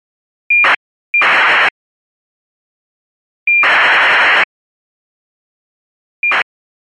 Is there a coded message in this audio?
Yes: ACARS aircraft data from 0.5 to 6.4 s, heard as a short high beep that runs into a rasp, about 2400 baud.